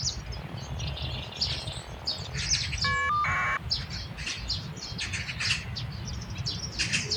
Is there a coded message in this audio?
Yes: caller ID data burst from 0.3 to 3.6 s, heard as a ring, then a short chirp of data, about 1200 baud, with the noise of a park.